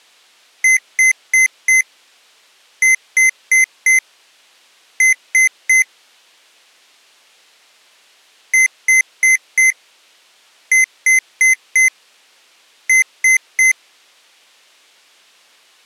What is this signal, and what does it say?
Beep code, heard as beeps from a small speaker, played twice, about 2050 Hz. 4-4-3. In Phoenix BIOS tables: maths coprocessor failure.